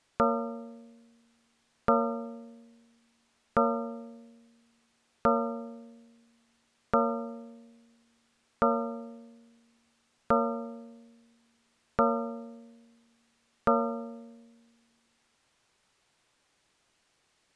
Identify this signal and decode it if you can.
Clock strike, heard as a bell. 9. Nine o'clock.